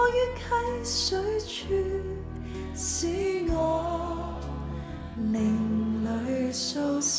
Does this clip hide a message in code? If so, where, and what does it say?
No.